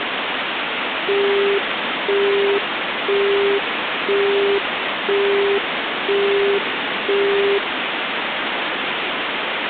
Telephone call progress tone (single-tone plan, as in Europe, Japan and elsewhere), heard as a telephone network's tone, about 400 Hz, 0.5 s on and 0.5 s off, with phone line noise. Busy tone.